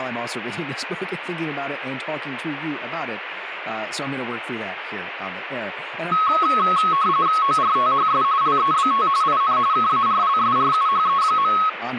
RTTY (45.45 baud, 170 Hz shift), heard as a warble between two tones, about 1190 Hz centre, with radio static and speech in English. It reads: ORTHS LEBT IN KARLSRUHE.